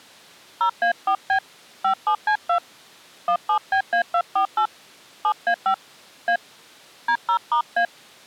DTMF, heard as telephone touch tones, dialled by hand, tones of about 90 ms. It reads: 0A4B 57C2 17BA248 7A5 A D0*A